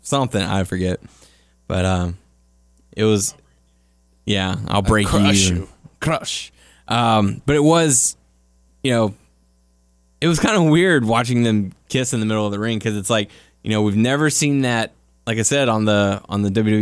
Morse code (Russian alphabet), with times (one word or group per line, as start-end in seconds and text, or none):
none